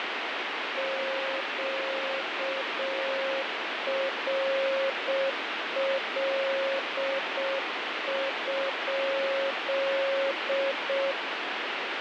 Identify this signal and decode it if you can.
Morse code, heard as a keyed tone, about 6 wpm, 540 Hz, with heavy radio static. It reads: QRL?